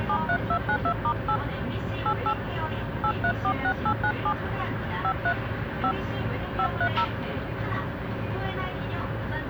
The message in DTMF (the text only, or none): 73292*8 88 8346897 53 5 530